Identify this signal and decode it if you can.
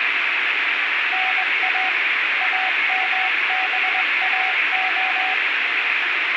Morse code, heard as a keyed tone, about 21 wpm, 750 Hz, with radio static and room echo. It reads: NA AMBAO